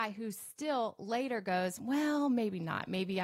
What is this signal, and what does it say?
Speech in English. There is no code.